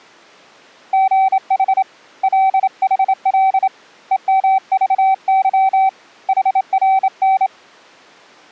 Morse code, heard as a keyed tone, hand-sent with a straight key, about 27 wpm, 770 Hz. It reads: GH LHL EMVY HRN